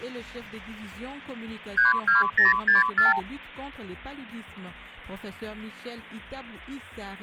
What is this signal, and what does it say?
Multi-frequency trunk signalling (R2, with the far end's replies), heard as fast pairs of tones, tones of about 150 ms. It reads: 32064